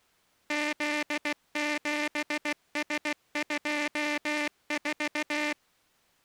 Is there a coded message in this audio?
Yes: Morse code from 0.4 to 5.6 s, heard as a buzzer, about 16 wpm. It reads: Z7S24